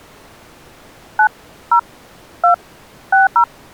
DTMF, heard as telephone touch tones, dialled by hand, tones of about 120 ms. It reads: 9 0 2 60